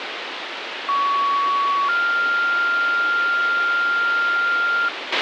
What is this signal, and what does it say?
Two-tone page, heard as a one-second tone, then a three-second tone, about 1120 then 1400 Hz, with radio hiss and a squelch burst at the end.